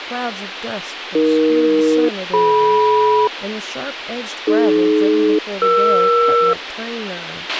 Aircraft SELCAL, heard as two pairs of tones, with radio hiss, a squelch burst at the end and speech in English. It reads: AE-DM AD-ER